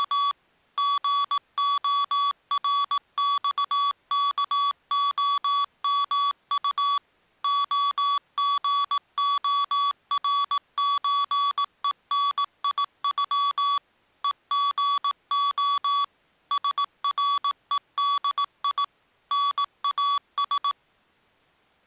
Morse code (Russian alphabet), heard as electronic beeps, machine-sent, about 18 wpm, 1140 Hz. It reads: … ГОРЬКОМУ ОГОРЧЕНИЮ ЕГО СРЕДИ НАС